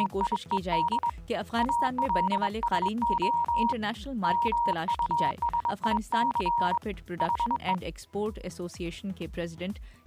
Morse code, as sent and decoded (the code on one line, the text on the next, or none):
… / .- .-.. ... --- / -- ..- ... .. -.-. / .... .
… ALSO MUSIC HE